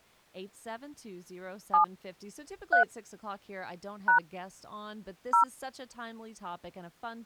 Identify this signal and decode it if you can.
DTMF, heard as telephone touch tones, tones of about 110 ms, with speech in English. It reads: 7 3 # 0